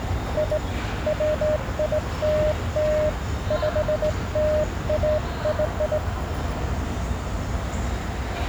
Morse code (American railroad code), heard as a keyed tone, hand-sent with a straight key, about 610 Hz, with the noise of a subway station. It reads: I WILL PLAY